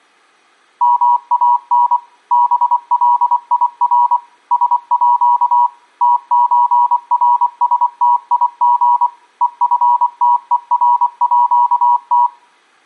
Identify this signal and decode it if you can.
Morse code (with Swedish letters), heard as a keyed tone, machine-sent, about 24 wpm, 970 Hz, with room echo. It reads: MAN BLIR SÅ TÖRSTIG EFTERÅT